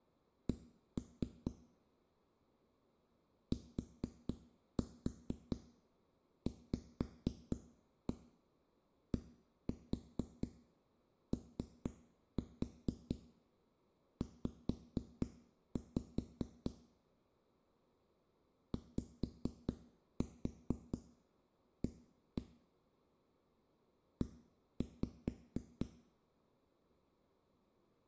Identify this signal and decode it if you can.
Tap code, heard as knocks on a wall, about 4 knocks a second, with room echo. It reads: C TVDOZ YA E